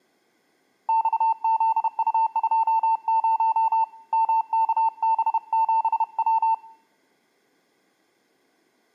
Morse code, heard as a keyed tone, hand-sent with a paddle, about 31 wpm, 900 Hz, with room echo. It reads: XZU20 MKB7W